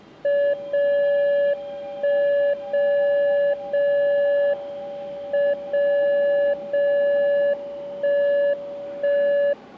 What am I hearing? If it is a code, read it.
Radio time signal (WWVB), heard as a tone whose level steps once a second, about 570 Hz, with the noise of a subway station. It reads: 0 1 0 0 M 0 0 1 1